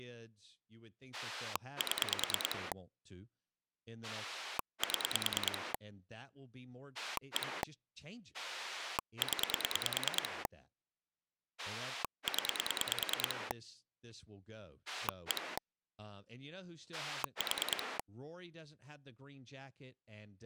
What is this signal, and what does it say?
Pulse dialling, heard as a rotary dial, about 9 pulses a second, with speech in English. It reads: 7 7 1 0 0 1 4